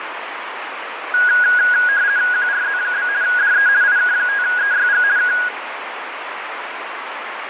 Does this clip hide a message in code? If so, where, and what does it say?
Yes: RTTY (50 baud, 170 Hz shift) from 1.1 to 5.5 s, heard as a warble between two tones, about 1550 Hz centre, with radio static. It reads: QRZ? DE IK5EYG K